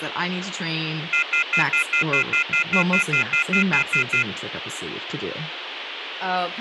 Telephone call progress tone (North American plan), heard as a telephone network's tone, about 1400, 2050, 2450, 2600 Hz, 0.1 s on and 0.1 s off, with phone line noise and speech in English. Off-hook warning tone.